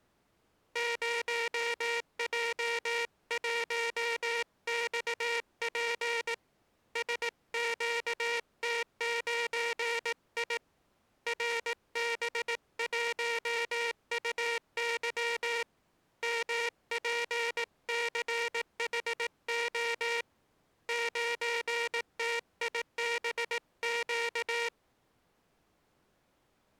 Morse code, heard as a buzzer, hand-sent with a paddle, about 18 wpm. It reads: 0J1XP SQT9I RB1UY MPCHO 9TIBQ